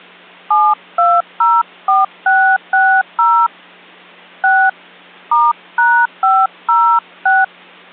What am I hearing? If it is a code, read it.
DTMF, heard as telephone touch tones, dialled by hand, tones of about 240 ms. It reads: 7204660 6 *#506